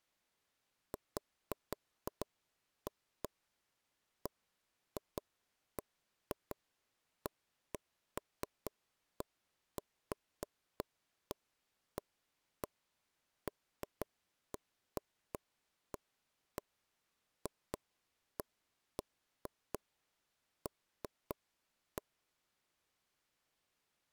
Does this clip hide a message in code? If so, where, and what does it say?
No, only irregular taps on a table.